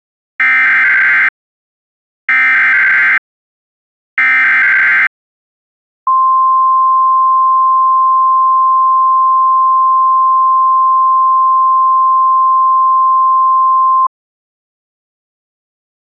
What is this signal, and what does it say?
Emergency Alert System (SAME) tones (header bursts, then the 1050 Hz attention tone), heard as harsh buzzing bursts, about 520.83 baud.